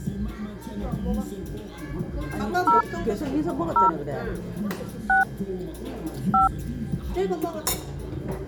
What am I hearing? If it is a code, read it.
DTMF, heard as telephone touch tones, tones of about 140 ms, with the noise of a restaurant. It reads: 0 0 6 5